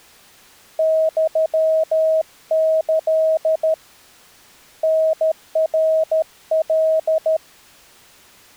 Morse code (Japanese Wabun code), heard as a keyed tone, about 13 wpm, 640 Hz. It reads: ユキ タナカ